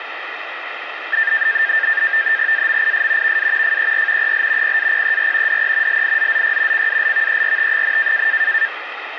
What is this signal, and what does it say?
NAVTEX (SITOR-B), 100 baud, 170 Hz shift, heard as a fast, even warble, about 1700 Hz centre, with radio static. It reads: AMIS VA FER EL PAPER DE LIZZY CALVERT,